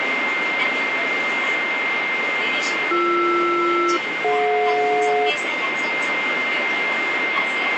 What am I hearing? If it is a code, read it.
Aircraft SELCAL, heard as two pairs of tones, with radio static, a steady whistle near 2100 Hz and the noise inside a subway train. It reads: BR-DJ